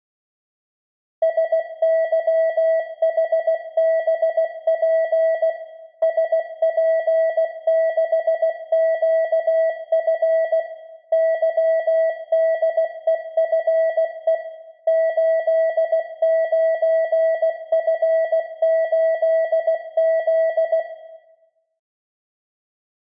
Morse code, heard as a keyed tone, machine-sent, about 16 wpm, 650 Hz, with room echo. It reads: SYHBP SP6QF YDEFE 89F8Z